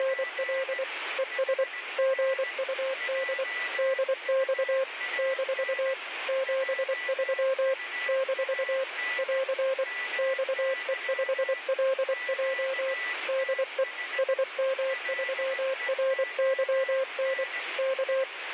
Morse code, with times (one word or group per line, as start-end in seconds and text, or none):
0.0-0.8 …
1.2-1.6 ES
2.0-3.4 GUD
3.8-4.8 DX
5.2-5.9 -
6.3-7.7 73
8.1-8.8 -
9.2-9.8 <AR>
10.2-12.9 XE5LJ
13.3-13.8 DE
14.2-17.4 SM3RYN
17.8-18.2 K